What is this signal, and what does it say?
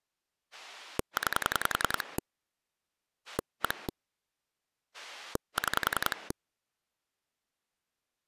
Pulse dialling, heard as a rotary dial, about 10 pulses a second. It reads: 9 1 6